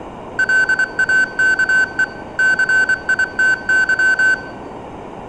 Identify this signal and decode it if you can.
Morse code, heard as electronic beeps, machine-sent, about 24 wpm, 1550 Hz, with room echo. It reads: LAKE CITY